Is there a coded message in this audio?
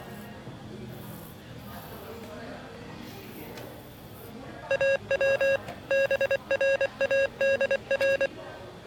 Yes: Morse code (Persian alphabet) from 4.6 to 8.3 s, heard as electronic beeps, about 24 wpm, 550 Hz, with the noise of a cafe. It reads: او برادر